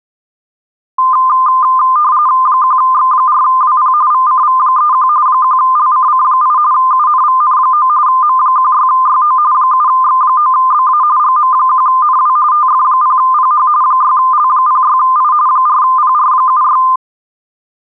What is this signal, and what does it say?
RTTY (45.45 baud, 170 Hz shift), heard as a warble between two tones, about 1120 Hz centre. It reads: 1X4WP VCV31 1LCC8 UNVN9 M16YO 7X9BA GM1NW TF0PH 6L06I 4PR76